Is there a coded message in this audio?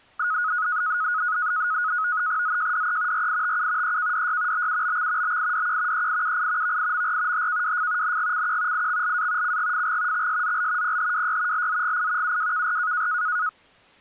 Yes: NAVTEX (SITOR-B), 100 baud, 170 Hz shift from 0.2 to 13.5 s, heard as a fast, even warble, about 1360 Hz centre. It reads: ZJDE RITU EKDY BUBX BIDQ EIUI VIMR HKWF NGCQ IXLA CGFG XSZL PHWY LZGI UWKR